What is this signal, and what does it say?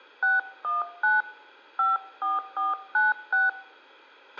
DTMF, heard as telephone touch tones, dialled by hand, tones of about 170 ms, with a squelch burst at the end and room echo. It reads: 619 54496